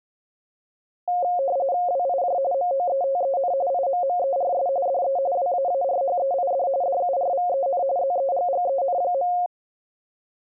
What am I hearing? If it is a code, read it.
RTTY (45.45 baud, 170 Hz shift), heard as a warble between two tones, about 630 Hz centre. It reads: WIJ MOETEN IMMERS DE WAARHEID DURVEN ZEGGEN.